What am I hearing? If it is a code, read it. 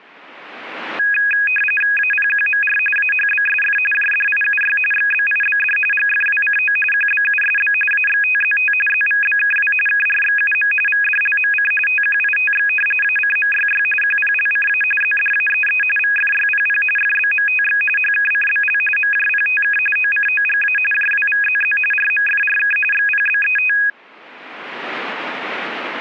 RTTY (45.45 baud, 850 Hz shift), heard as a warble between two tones, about 2100 Hz centre. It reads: APQMR AHBSF JDIUY XBIBD GFWCO QBUSB AXTZT ZVBKW KRXUM VDLMC TQITX ACMYY QPLCA ZDAEE VFYPP FBMTX HKCBL MJPTK OCOGA JWVZZ RMFRK XPBET